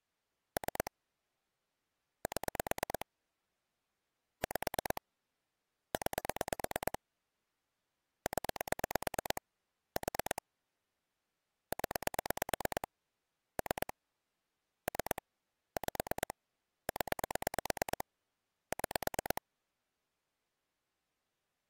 Pulse dialling, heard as clicks on a phone line, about 9 pulses a second. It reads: 3 7 5 9 0 4 0 3 3 5 0 6